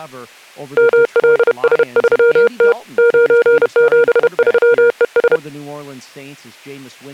Morse code, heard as a keyed tone, hand-sent with a paddle, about 31 wpm, 470 Hz, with speech in English. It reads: MLS3T 973ES